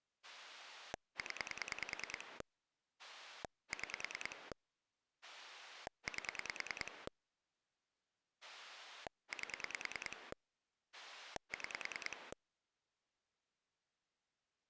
Pulse dialling, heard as a rotary dial, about 10 pulses a second. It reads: 0 6 8 8 6